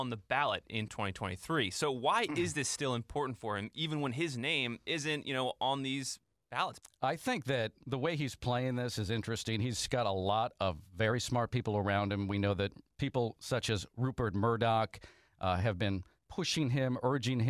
Speech in English. There is no code.